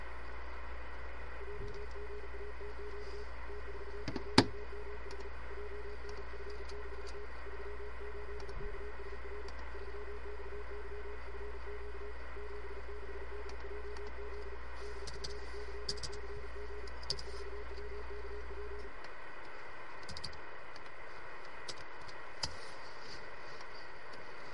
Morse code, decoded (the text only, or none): JGATQ T42MH JNF6T 38KSR 3XYFQ 76DJZ DFYCG E4WKP